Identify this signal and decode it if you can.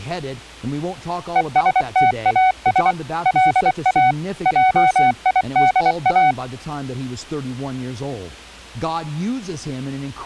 Morse code, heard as a keyed tone, machine-sent, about 24 wpm, 750 Hz. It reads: ESTAS LA JIDA